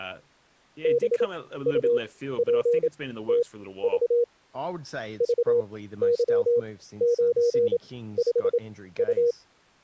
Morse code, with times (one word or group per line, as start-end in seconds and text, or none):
0.8-4.2 BUPTV
5.2-9.3 VY95U